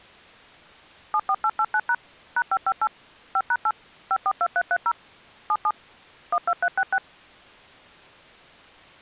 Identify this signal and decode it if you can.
DTMF, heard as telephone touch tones, dialled by machine, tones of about 60 ms. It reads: 74889# #558 5#8 542330 77 12366